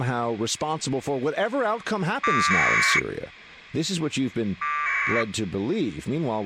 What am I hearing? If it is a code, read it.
Packet radio (AX.25, as in APRS), 1200 baud, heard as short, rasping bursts, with speech in English.